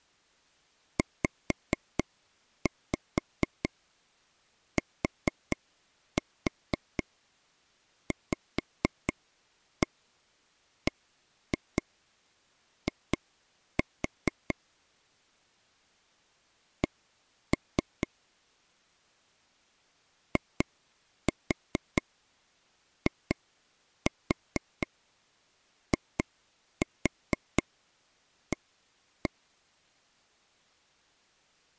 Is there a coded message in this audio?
Yes: tap code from 1.0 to 29.3 s, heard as taps on a table, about 4 knocks a second. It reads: ZTVBI C IIIA